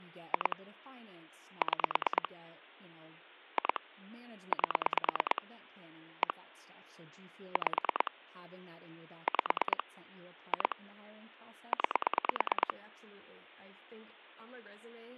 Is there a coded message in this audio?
Yes: pulse dialling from 0.3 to 12.7 s, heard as clicks on a phone line, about 9 pulses a second, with speech in English. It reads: 2 6 2 8 1 5 5 2 9